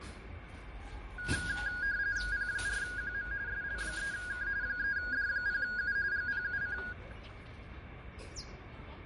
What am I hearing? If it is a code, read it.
RTTY (45.45 baud, 170 Hz shift), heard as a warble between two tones, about 1550 Hz centre, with radio static, fading and the noise of a residential street. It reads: P4QM SL3K 3D0U GPUC